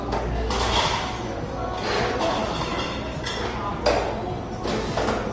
The noise of a cafe. There is no code.